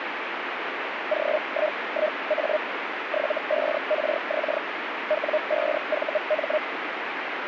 Hellschreiber (Feld-Hell, 122.5 baud), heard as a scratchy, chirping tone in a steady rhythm, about 610 Hz, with radio static. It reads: G11A 75RX W5VM